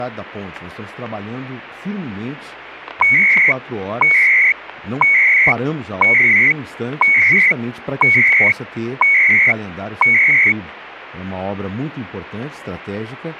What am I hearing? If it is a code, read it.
Radio time signal (CHU, Canada), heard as beeps and data bursts, one a second, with static crashes.